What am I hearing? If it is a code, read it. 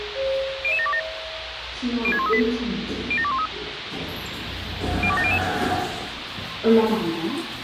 Five-tone selective call (ZVEI), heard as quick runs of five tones, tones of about 70 ms, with radio hiss, a squelch burst at the end and the noise inside a lift. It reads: 00727 06138 07213 02700